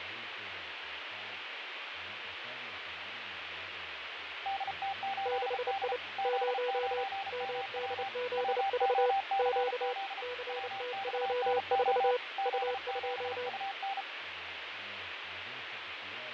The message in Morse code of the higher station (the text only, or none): DT8D Z9MW WOCZ WXNO Z7UN